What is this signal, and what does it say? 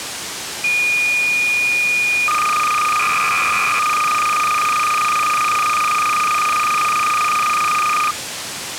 Cassette data (Kansas City type), 300 baud, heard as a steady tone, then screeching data, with tape hiss.